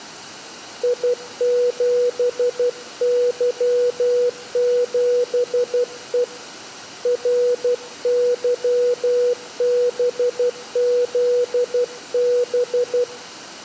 Morse code, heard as a keyed tone, hand-sent with a paddle, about 12 wpm, 490 Hz. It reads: I7Y7E RYBZB